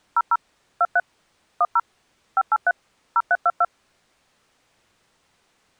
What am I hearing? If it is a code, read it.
DTMF, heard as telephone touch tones, dialled by machine, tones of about 40 ms. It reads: 00 23 10 583 0322